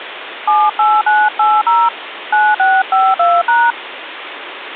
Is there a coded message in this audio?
Yes: DTMF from 0.5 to 3.7 s, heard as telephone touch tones, dialled by hand, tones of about 220 ms, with phone line noise. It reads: 78980 9652#